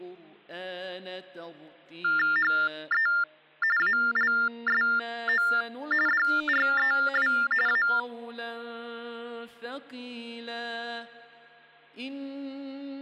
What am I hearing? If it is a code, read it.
TTY/TDD text telephone tones (45.45 baud Baudot), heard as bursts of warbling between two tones, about 400 Hz shift, 1600 Hz centre. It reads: HE ALSO DREW A